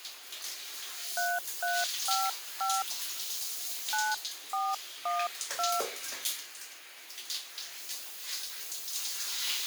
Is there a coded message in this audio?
Yes: DTMF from 1.2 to 5.8 s, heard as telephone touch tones, dialled by hand, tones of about 220 ms, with the noise of a restroom. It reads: 3355 9412